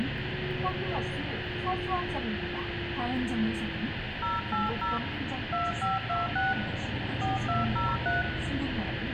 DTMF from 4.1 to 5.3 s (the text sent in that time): 080